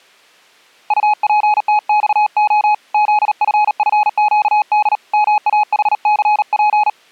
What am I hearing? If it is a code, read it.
Morse code, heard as a keyed tone, hand-sent with a paddle, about 38 wpm, 840 Hz. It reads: UPTXO ZFFQD MAHCP